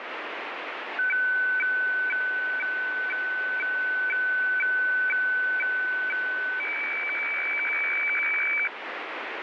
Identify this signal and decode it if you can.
Weather fax (radiofax), 120 lines a minute, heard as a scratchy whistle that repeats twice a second, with radio static.